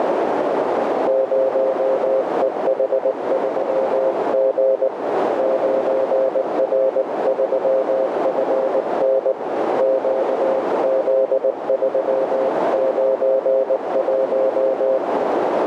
Morse code, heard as a keyed tone, hand-sent with a paddle, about 19 wpm, 530 Hz, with heavy radio static and a narrow filter. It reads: 0EH3G 9R3FN QZ391